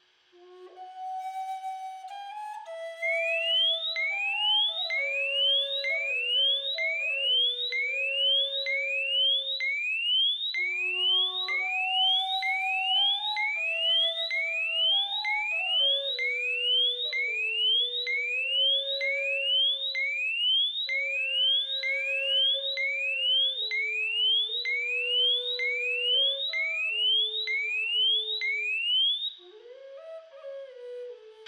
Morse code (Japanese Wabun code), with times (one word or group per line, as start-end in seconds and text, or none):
none